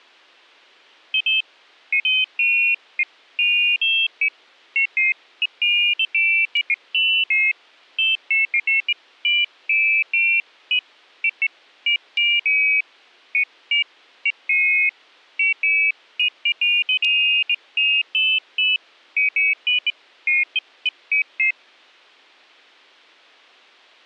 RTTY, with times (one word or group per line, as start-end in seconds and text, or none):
none